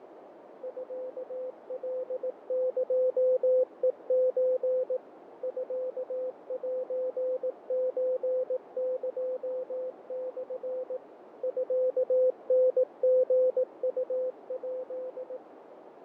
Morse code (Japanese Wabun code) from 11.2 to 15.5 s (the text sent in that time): ミタリウヱ